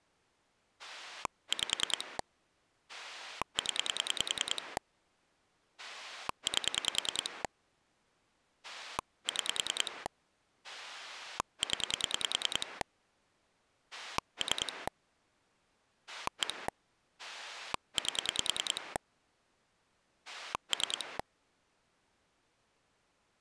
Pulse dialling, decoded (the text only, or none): 5 0 8 6 0 3 1 8 3